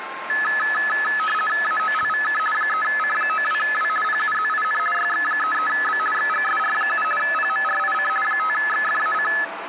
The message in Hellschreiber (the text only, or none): none